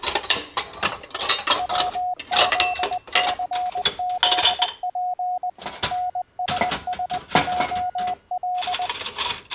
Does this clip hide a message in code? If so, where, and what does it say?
Yes: Morse code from 1.5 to 8.9 s, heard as a keyed tone, machine-sent, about 20 wpm, 730 Hz, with kitchen noise. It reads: WZCZP NSSJL